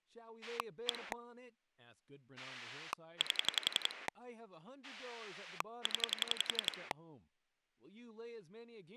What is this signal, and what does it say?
Pulse dialling, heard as a rotary dial, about 11 pulses a second, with speech in English. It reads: 1 8 0